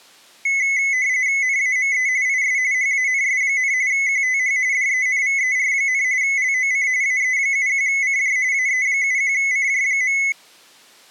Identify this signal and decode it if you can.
RTTY (45.45 baud, 170 Hz shift), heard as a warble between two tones, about 2100 Hz centre. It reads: NAME IS HANS, QTH DENVER, LOC AE71CJ AE71CJ.